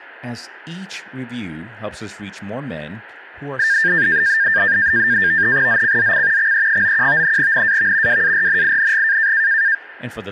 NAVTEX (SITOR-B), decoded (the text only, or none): ZCZC XE91 NAV WARNING